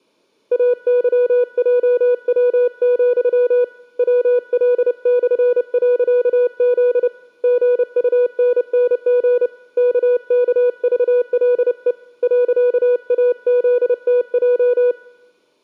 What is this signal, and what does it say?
Morse code, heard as a keyed tone, hand-sent with a paddle, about 30 wpm, 490 Hz. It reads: AYJW, WL/.Z GUNNG KKVLE .AZTJ